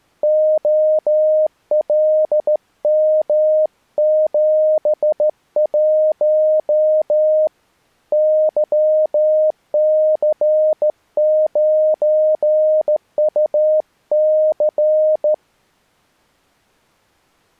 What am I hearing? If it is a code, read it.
Morse code, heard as a keyed tone, hand-sent with a straight key, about 14 wpm, 620 Hz. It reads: OLM71 YC9UC